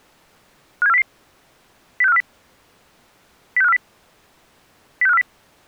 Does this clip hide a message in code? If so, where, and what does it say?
Yes: five-tone selective call (EEA) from 0.8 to 5.2 s, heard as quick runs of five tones, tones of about 40 ms. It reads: 57400 06540 06540 06540